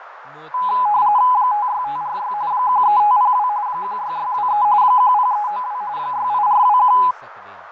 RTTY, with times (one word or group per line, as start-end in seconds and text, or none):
1.3-2.3 56546
2.5-3.5 13502
3.7-4.6 16623
4.8-5.8 10392
6.0-7.0 68421